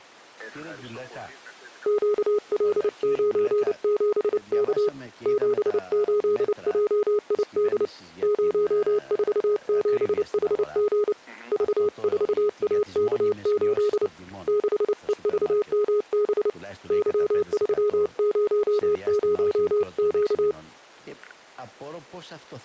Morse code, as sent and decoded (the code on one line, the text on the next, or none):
--.- .-.. ----. --... -.- / --... ---.. .--- .. -.. / ----- ....- --... .... --. / ...- ....- .- -.- ---.. / -.... . ...- -- -... / -.-- ...-- ----- ----- --.-
QL97K 78JID 047HG V4AK8 6EVMB Y300Q